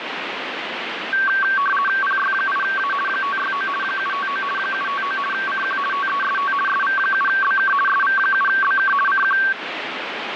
RTTY (50 baud, 450 Hz shift), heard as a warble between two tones, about 1340 Hz centre, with radio static. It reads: PY8A 569 759 759 CQ TEST SV7BK SV7BK CQ